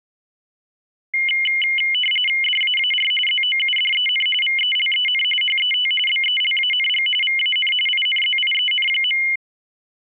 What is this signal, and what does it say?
RTTY (45.45 baud, 850 Hz shift), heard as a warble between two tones, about 2550 Hz centre. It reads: DAAR ZOUDEN VELEN HET BELANG VAN INZIEN.